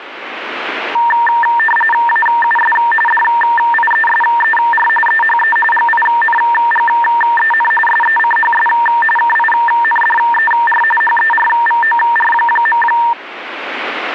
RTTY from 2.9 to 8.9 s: DIESER EHE GINGEN SECHS

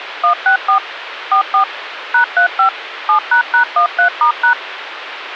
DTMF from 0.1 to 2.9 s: 164 44 #35

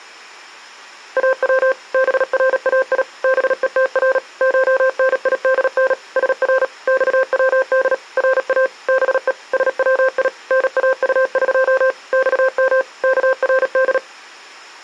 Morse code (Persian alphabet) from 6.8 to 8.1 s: خود

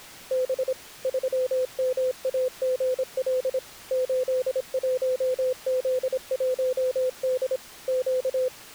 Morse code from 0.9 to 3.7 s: 3MAGL

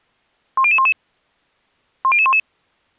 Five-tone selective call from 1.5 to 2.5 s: 10011

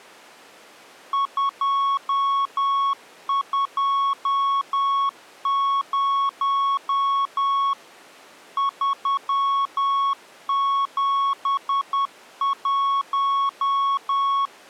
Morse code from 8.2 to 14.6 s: 371

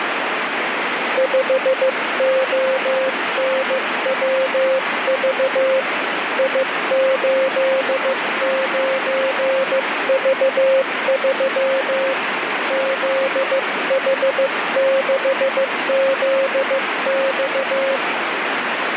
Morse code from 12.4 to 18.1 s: ZH6ZX

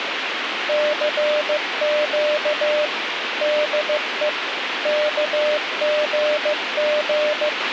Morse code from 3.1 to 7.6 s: DE KGG

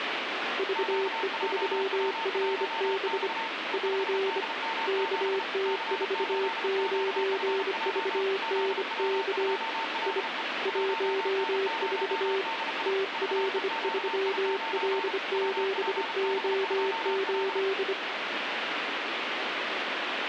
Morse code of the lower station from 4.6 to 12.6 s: KT49VNK I 14

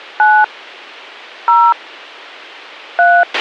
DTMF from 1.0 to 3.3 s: 0 3

